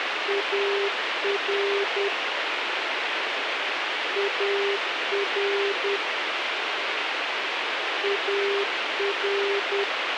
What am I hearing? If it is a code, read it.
Morse code, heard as a keyed tone, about 10 wpm, 400 Hz, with radio hiss. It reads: AR AR AR